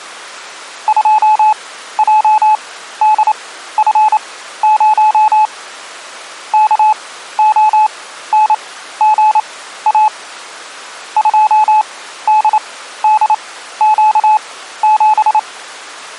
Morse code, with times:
0.9-5.5 2JDF0
6.5-10.1 KONGA
11.2-15.4 2DDQ7

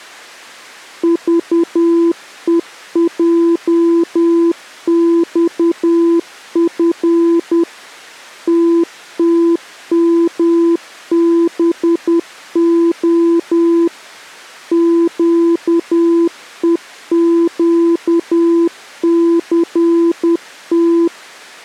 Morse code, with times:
1.0-7.6 VEJXF
8.5-13.9 TTMBO
14.7-21.1 QEQCT

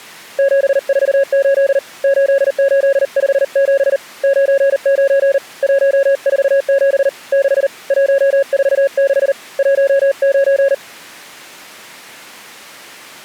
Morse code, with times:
0.4-1.8 748
2.0-4.0 8857
4.2-5.4 99
5.6-7.1 147
7.3-7.7 6
7.9-9.3 146
9.6-10.7 19

